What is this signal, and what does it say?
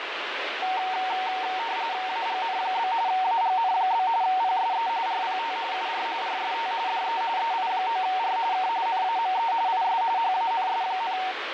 RTTY (45.45 baud, 170 Hz shift), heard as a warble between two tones, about 830 Hz centre, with radio static. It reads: AGN? AGN? PSE RPT UR RST DE EI9R K NAME IS HANS,